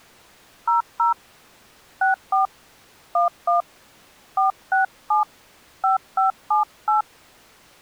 DTMF, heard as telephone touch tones, dialled by hand, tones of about 130 ms. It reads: 00 64 11 467 5578